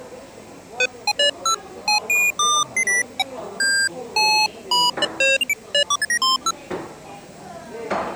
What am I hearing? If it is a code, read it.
Electronic bleeps of random pitch and length, with the noise of a cafe. There is no code.